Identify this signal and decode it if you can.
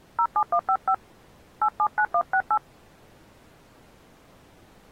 DTMF, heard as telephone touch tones, dialled by hand, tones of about 70 ms. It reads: 07155 879168